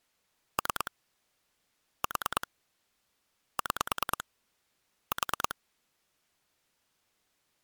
Pulse dialling, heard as clicks on a phone line, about 9 pulses a second. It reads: 3 4 6 4